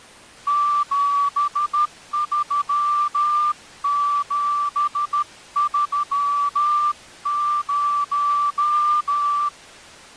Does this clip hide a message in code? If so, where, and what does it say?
Yes: Morse code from 0.4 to 9.5 s, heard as a whistle, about 13 wpm. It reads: 73730